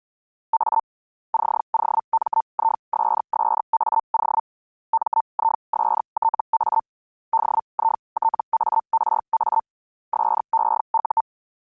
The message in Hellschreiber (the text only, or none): A COMISSAO MISTA DITARA SEU